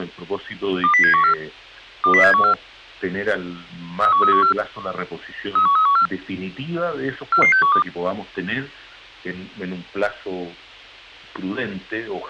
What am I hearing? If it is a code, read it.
Five-tone selective call (CCIR), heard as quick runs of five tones, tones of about 100 ms. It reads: 20714 20714 31314 31314 44612